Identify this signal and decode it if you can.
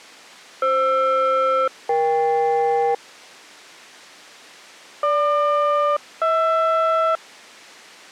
Aircraft SELCAL, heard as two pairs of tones. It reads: FR-EK GQ-HR